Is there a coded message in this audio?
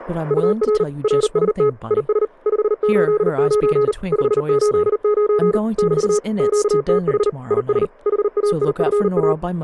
Yes: Morse code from 0.2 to 9.4 s, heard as a keyed tone, machine-sent, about 39 wpm, 420 Hz, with speech in English. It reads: UR RST IS 589 589 <BT> QTH IS HAIFA